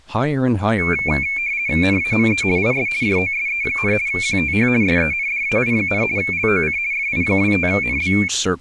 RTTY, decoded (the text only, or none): NAME IS JOSE, QTH SENDAI, LOC FI25NB